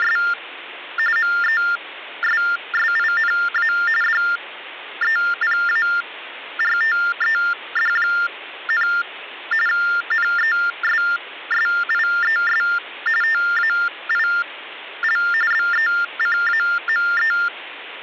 TTY/TDD text telephone tones (45.45 baud Baudot), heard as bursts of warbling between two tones, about 400 Hz shift, 1600 Hz centre, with phone line noise. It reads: … MESSINA DEPARTED, NESSIES TAIL BECAME